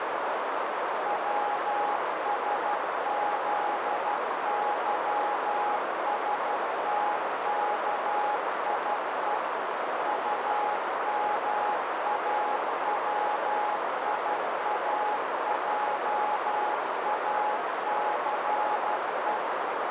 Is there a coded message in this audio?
Yes: Morse code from 1.0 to 19.4 s, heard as a keyed tone, machine-sent, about 12 wpm, 830 Hz, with heavy radio static and a narrow filter. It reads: WSZYSTKIE UMAWIAJACE